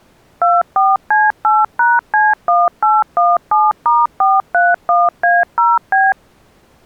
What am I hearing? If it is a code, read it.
DTMF, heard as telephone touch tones, dialled by machine, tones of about 200 ms. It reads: 24C8#C1817*431A0B